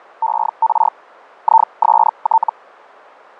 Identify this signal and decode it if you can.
Hellschreiber (Feld-Hell, 122.5 baud), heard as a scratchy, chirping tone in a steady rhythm, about 900 Hz, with fading. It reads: ER IST